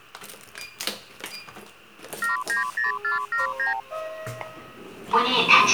Multi-frequency trunk signalling (R2, with the far end's replies), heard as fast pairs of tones, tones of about 140 ms, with the noise inside a lift. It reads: 790479